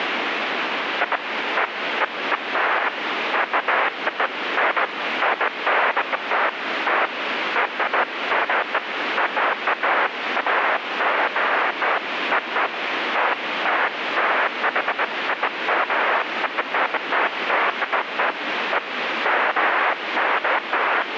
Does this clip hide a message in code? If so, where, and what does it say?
No, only bursts of noise, with radio static.